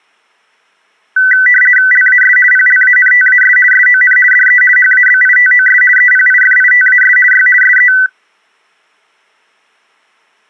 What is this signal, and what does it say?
RTTY (50 baud, 450 Hz shift), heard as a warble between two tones, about 1750 Hz centre. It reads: LAS PLANTAS SON DE HABITOS EPIFITAS Y SE